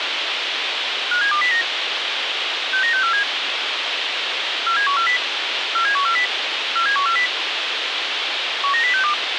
Five-tone selective call (CCIR), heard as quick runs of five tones, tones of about 100 ms, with radio hiss. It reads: 57209 69647 47140 47140 47140 19062